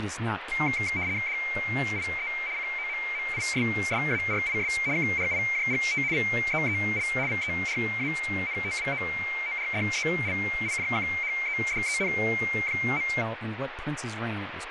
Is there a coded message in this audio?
Yes: RTTY (75 baud, 170 Hz shift) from 0.5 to 13.2 s, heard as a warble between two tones, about 2200 Hz centre, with radio static and speech in English. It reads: DIE COMMISSARIS KRIJGT VEEL VERANTWOORDELIJKHEDEN.